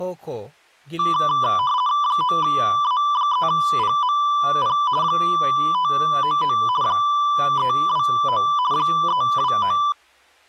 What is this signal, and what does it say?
RTTY (50 baud, 170 Hz shift), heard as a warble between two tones, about 1080 Hz centre, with speech in Bodo. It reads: 9A3PMP 599 329 329